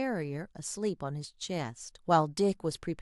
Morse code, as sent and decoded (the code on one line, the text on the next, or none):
none